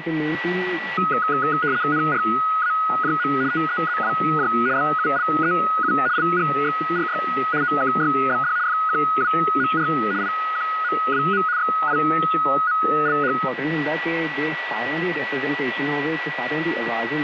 RTTY (75 baud, 170 Hz shift), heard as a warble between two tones, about 1360 Hz centre, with radio static and a steady whistle near 1950 Hz. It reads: NRAJM TEZWJ BULEU LGXRY OKYBD FQWMR IQMWM XIMLH